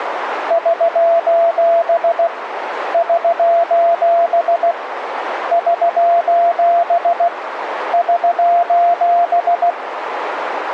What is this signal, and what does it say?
Morse code, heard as a keyed tone, hand-sent with a paddle, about 16 wpm, 680 Hz, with radio static and a narrow filter. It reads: <SOS> <SOS> <SOS> <SOS>